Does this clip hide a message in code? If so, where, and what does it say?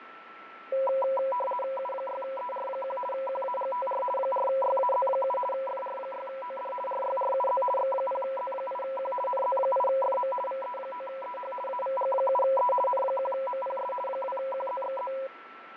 Yes: RTTY (50 baud, 450 Hz shift) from 0.7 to 15.3 s, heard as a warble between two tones, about 760 Hz centre, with radio static, fading and a steady whistle near 1330 Hz. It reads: U6ER1 QAGTR 4YAZ7 FR6OD RYRUZ X0Z8Q NZ8FM VE9EH AVG7E N1MPS 2QZXZ